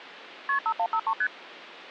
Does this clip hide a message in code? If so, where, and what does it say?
Yes: multi-frequency trunk signalling (R1, as on North American trunks) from 0.5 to 1.3 s, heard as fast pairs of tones, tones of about 70 ms. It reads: KP 5153 ST